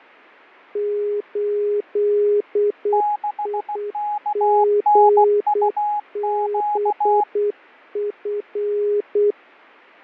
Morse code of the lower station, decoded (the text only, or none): 8IGBF